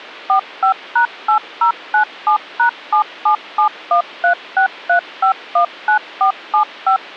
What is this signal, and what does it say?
DTMF, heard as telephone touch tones, dialled by machine, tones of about 100 ms. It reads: 45#8097#7771363519475